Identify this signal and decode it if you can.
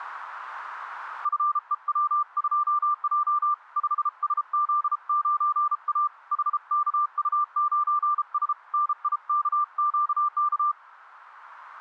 Morse code, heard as a keyed tone, hand-sent with a paddle, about 33 wpm, 1180 Hz. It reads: FEW2J 5SZ9A HKU9S NIKQK